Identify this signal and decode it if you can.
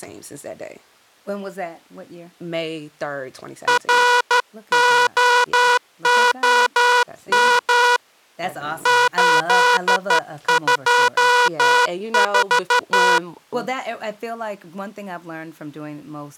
Morse code, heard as a buzzer, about 13 wpm, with speech in English. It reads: ROOM 824